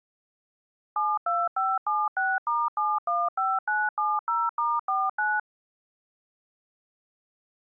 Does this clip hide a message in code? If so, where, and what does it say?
Yes: DTMF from 1.0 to 5.4 s, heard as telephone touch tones, dialled by machine, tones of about 220 ms. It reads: 72576*715970*49